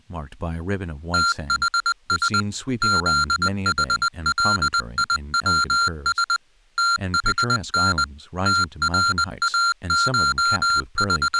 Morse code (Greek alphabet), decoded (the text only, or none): ΤΗΣ ΖΗΛΙΩΣ ΤΗΝ …